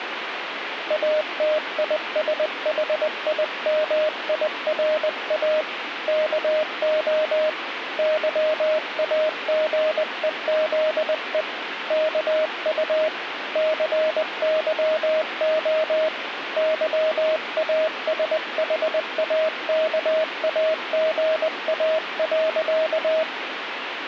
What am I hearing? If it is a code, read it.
Morse code, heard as a keyed tone, hand-sent with a paddle, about 20 wpm, 620 Hz, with radio static. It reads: ATISHIMIRA KO YAGEZE KU CYO YASHAKAGA.